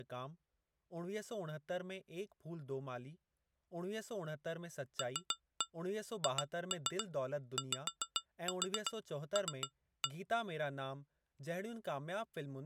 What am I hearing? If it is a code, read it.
Tap code, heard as taps on glass, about 7 knocks a second, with speech in Sindhi. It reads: LHYL